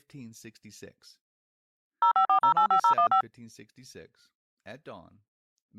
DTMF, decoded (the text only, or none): 054085015